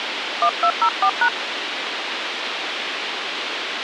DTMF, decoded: 1204#

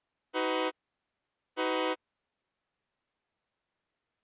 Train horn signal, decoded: 2 short

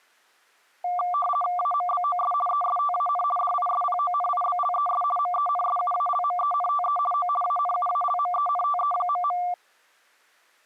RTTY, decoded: AMBOS ESTAN DISPONIBLES MENSUALMENTE O ANUALMENTE..

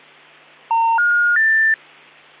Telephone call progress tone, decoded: special information tone

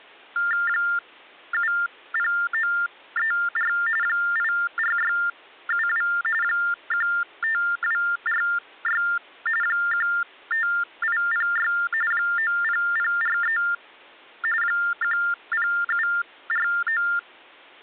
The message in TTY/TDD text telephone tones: 70934 84672 15246 15806 90043 10749

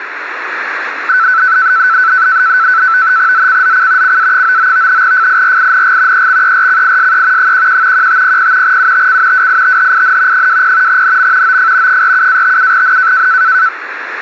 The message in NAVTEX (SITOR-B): ZCZC CA99 FIRING EXERCISE 11 1500 UTC WITHIN 20 NM OF 47-57N

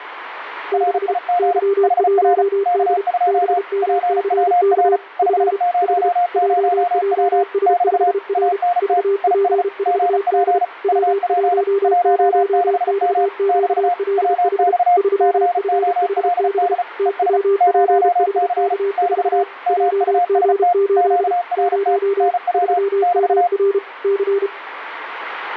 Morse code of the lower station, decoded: 6 Y1D BMCK F H JJS5R VP4D W10XQLH 3FHB TWPHK4 JG8 0 3MR C

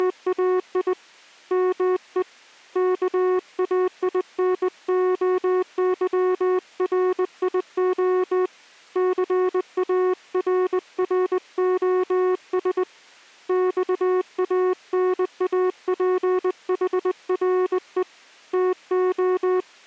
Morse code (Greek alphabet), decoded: … ΜΕ ΚΑΙΝΟΥΡΙΟ ΘΑΡΡΟΣ ΞΑΝΑΠΗΡΕ ΤΟ

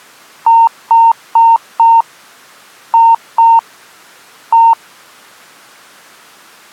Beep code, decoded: 4-2-1

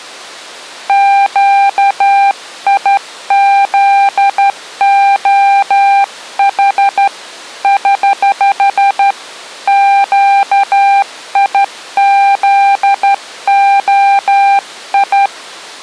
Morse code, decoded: QIZOH <HH> QIZOI

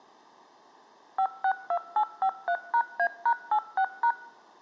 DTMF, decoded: 562853#A#86#

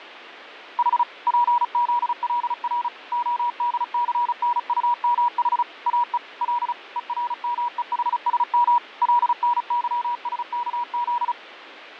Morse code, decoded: H PZLR ODCNUMH AE L ERMEHSM LNYSKZ

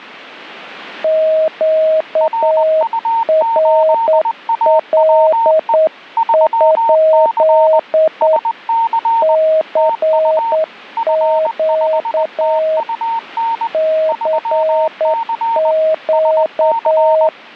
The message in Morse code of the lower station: QRL? CQ CQ

